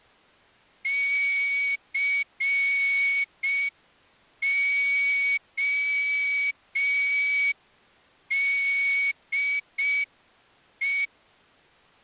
Morse code, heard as a whistle, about 5 wpm. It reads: CODE